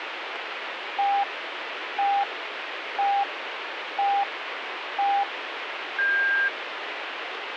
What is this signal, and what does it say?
Radio time signal (five pips and a higher one, as on Chinese radio), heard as pips, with radio static.